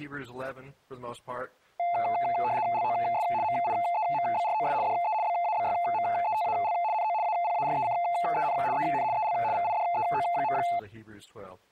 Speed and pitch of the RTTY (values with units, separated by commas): 75 baud, 170 Hz shift, 780 Hz centre